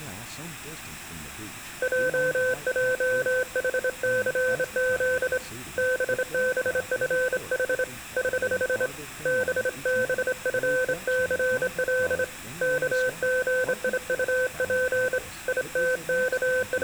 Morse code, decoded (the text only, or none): JJHCZ BBFH <HH> BBFCL KGIUP …